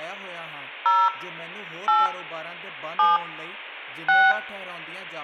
DTMF, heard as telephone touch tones, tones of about 180 ms, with room echo and speech in Punjabi. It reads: 0 8 7 6